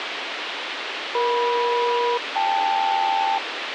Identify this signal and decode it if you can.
Aircraft SELCAL, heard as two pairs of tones, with radio hiss. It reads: EM-KL